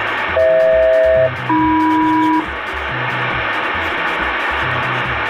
Aircraft SELCAL, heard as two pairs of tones, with radio static. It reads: FH-AM